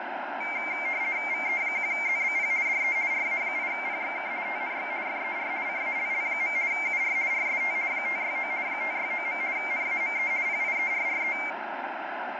RTTY (50 baud, 170 Hz shift), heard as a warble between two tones, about 2200 Hz centre, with radio static and fading. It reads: VE1ZBP DE RA8PXK TNX FER CALL. UR RST 569 569. NAME PIERRE